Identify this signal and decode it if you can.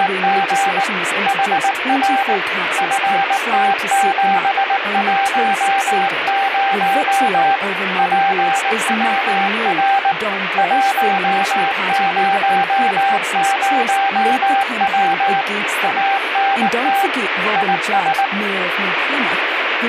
Morse code, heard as a keyed tone, hand-sent with a paddle, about 19 wpm, 790 Hz, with radio static and speech in English. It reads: … HR FT710 PWR 100W ANT IS